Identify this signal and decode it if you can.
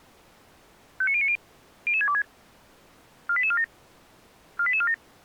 Five-tone selective call (ZVEI), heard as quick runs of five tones, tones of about 70 ms. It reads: 59090 00626 48847 48847